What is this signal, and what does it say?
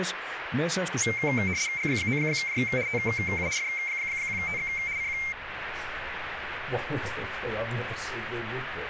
RTTY (75 baud, 170 Hz shift), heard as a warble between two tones, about 2200 Hz centre, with radio static. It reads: G9J TU F1TX CQ